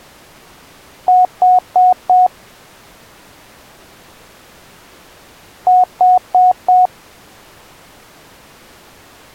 Beep code, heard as beeps, played twice, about 730 Hz. 4 short. In AMI BIOS tables: system timer failure; in Dell tables: memory read or write failure.